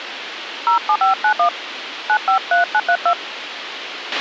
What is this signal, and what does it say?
DTMF, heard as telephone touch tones, dialled by hand, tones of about 90 ms, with radio hiss and a squelch burst at the end. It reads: 07591 953932